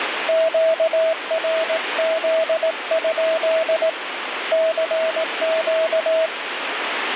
Morse code, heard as a keyed tone, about 18 wpm, 650 Hz, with radio static. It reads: QRZ? CQ